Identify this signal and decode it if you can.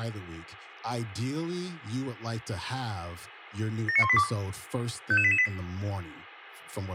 Five-tone selective call (ZVEI), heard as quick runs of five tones, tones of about 70 ms, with room echo and speech in English. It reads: 79182 55888